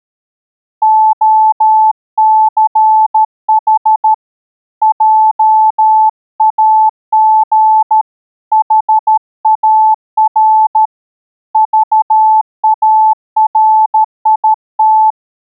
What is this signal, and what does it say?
Morse code, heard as a keyed tone, hand-sent with a paddle, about 13 wpm, 870 Hz. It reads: OCH JAG HAR VARIT